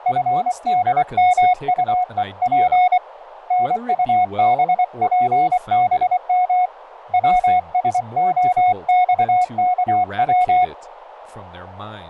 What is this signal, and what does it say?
Morse code, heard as a keyed tone, hand-sent with a paddle, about 24 wpm, 730 Hz, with radio static and speech in English. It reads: FDMUEP NUBPBM WSOXKW